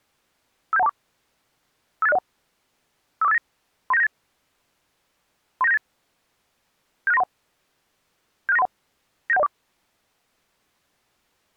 Five-tone selective call (EIA), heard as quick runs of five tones, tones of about 30 ms. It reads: 57124 58601 54589 39798 39798 76931 76931 97104